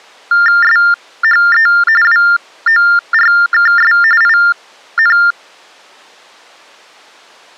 TTY/TDD text telephone tones (45.45 baud Baudot), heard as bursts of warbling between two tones, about 400 Hz shift, 1600 Hz centre. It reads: SHE WORKS IN